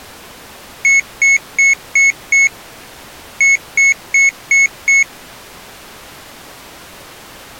Beep code, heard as a piezo beeper, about 2200 Hz. 5-5.